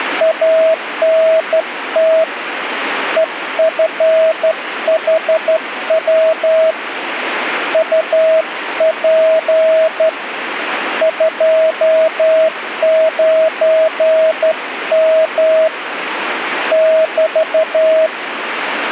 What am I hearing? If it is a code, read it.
Morse code, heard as a keyed tone, hand-sent with a straight key, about 12 wpm, 640 Hz, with radio static. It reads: ANT EFHW UP 29M <BT>